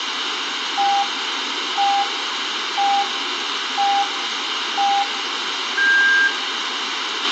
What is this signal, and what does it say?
Radio time signal (five pips and a higher one, as on Chinese radio), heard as pips, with radio hiss, a squelch burst at the end and room echo.